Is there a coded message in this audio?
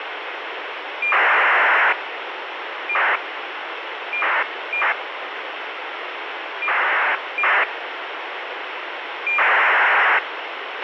Yes: ACARS aircraft data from 1.0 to 10.2 s, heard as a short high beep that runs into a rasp, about 2400 baud, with radio hiss and a squelch burst at the end.